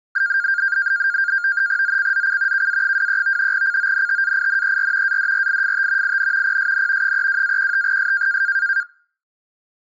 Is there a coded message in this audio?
Yes: NAVTEX (SITOR-B), 100 baud, 170 Hz shift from 0.2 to 8.8 s, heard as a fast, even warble, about 1500 Hz centre. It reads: ZCZC KA23 CONTAINER ADRIFT IN PSN 32-15S